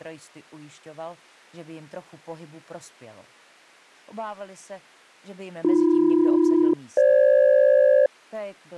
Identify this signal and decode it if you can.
Aircraft SELCAL, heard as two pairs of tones. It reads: AB-FG